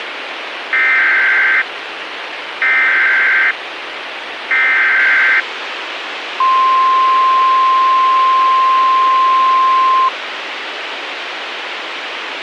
Emergency Alert System (SAME) tones (header bursts, then the 1050 Hz attention tone), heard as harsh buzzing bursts, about 520.83 baud, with radio hiss and a squelch burst at the end.